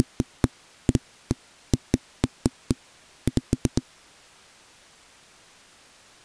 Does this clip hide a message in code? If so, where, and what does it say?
No, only irregular knocks on a wall.